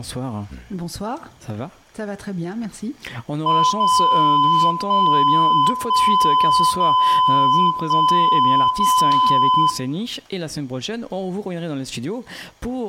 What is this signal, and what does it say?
Radio time signal (DCF77), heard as a tone whose level steps once a second, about 1010 Hz, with room echo. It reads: 0 1 1 0 1 0